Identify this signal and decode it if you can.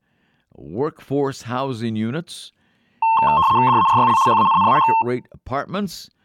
RTTY (75 baud, 170 Hz shift), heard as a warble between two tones, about 980 Hz centre, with speech in English. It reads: DARYL HANNAH